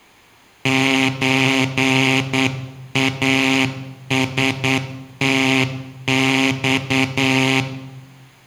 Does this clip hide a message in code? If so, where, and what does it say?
Yes: Morse code (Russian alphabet) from 0.6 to 7.7 s, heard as a buzzer, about 9 wpm, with room echo. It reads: ЧАСТЬ